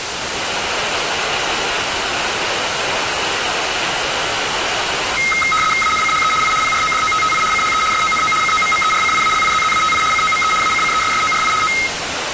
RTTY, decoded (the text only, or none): ANCHE I PRODOTTI CHE SONO COMMERCIALIZZATI COME ACCESSORI O